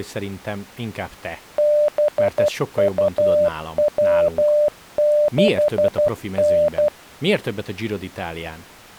Morse code, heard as a keyed tone, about 12 wpm, 600 Hz, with speech in Hungarian. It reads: BUW6N